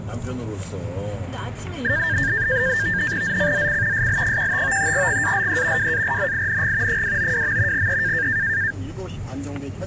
NAVTEX (SITOR-B), 100 baud, 170 Hz shift, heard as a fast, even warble, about 1700 Hz centre, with static crashes and the noise inside a car. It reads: ZCZC SL15 GALE WARNING 292. E